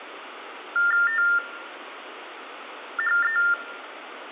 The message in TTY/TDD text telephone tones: THE

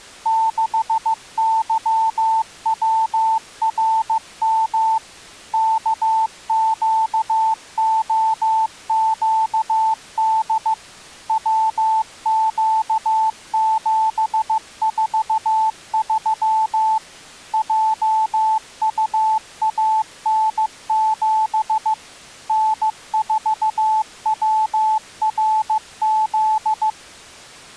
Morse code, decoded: 6YWRM KQOQD WQ743 JUAN7 N4WRZ

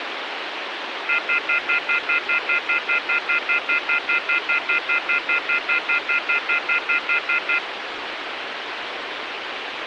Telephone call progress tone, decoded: off-hook warning tone

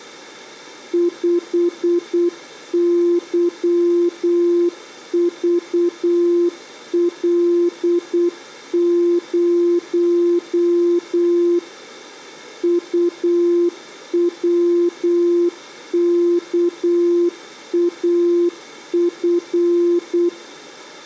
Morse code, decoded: 5YVL0 UWKAF

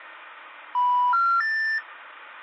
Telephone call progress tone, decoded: special information tone

